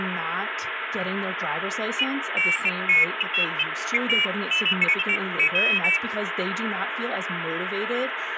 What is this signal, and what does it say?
Pairs of high tones at irregular times, with phone line noise and speech in English. There is no code.